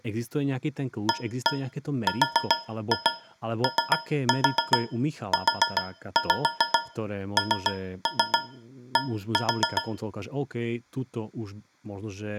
Tap code, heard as taps on a metal pipe, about 7 knocks a second, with speech in Slovak. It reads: AROUND